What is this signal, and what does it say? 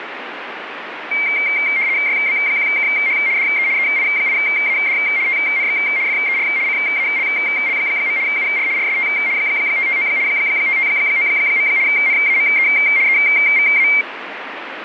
RTTY (75 baud, 170 Hz shift), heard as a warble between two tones, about 2200 Hz centre, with radio static. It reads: YB1KH DE EI8AD TNX FER CALL. UR RST 559 559. NAME EVA